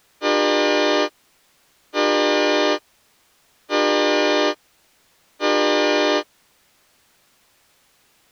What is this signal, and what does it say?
Train horn signal, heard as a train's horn. 4 short. On North American railways: a request for a signal to be given or repeated.